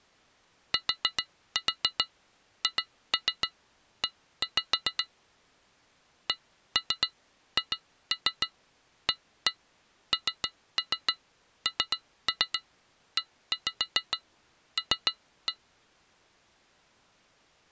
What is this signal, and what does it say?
Tap code, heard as taps on glass, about 7 knocks a second. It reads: THE CHANNEL